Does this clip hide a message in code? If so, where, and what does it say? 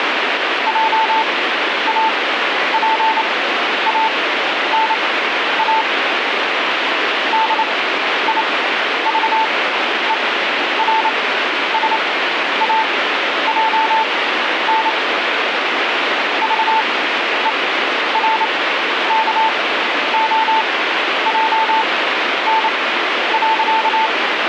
Yes: Morse code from 0.6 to 24.1 s, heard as a keyed tone, machine-sent, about 28 wpm, spaced as for 11 wpm, 890 Hz, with radio static. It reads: JAPANA DIVERSAJN VERKOJN.